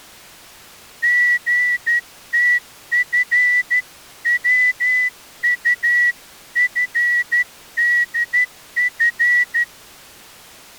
Morse code (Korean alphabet), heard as a whistle, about 12 wpm. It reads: 선비는